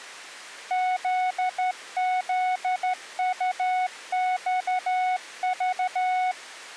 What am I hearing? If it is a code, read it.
Morse code, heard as a keyed tone, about 12 wpm, 740 Hz. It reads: ZZUXV